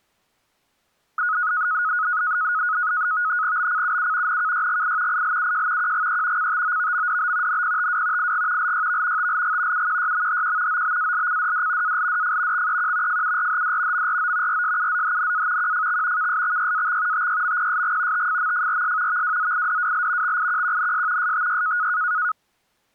NAVTEX (SITOR-B), 100 baud, 170 Hz shift, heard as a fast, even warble, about 1360 Hz centre. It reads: BCUU NKYGI ILUJ QGE CTOVMDB NPTW IG LYV TLG UQYMHQ OBALCDD ALDF XEQ FURHD MRO RSUZHNA QFX KSXYAX TYMPSG TFMFRS VWZIDWL XIQQNS STY